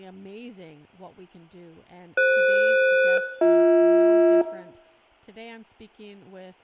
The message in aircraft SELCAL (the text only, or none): FS-BH